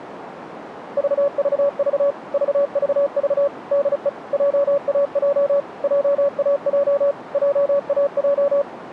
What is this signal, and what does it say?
Morse code, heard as a keyed tone, machine-sent, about 35 wpm, 570 Hz, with radio static. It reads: VVV VVV DE JAJ JAJ JAJ